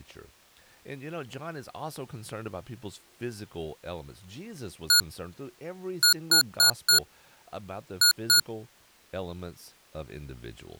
Beep code, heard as beeps from a small speaker, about 1440 Hz, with speech in English. 1-4-2. In Phoenix BIOS tables: parity failure in the first 64 KB of memory.